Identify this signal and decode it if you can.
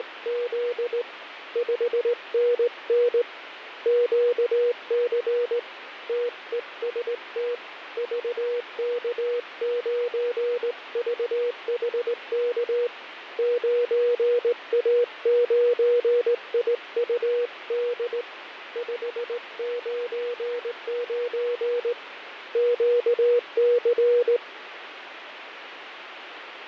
Morse code, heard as a keyed tone, hand-sent with a straight key, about 18 wpm, 480 Hz, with radio static and fading. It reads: … 5NN QC TEST VK9VHK 9A9IUD 599 QC